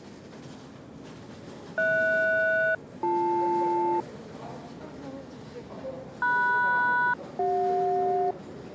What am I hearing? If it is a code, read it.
Aircraft SELCAL, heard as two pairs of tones, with the noise of a subway station. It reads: HS-BL MS-CJ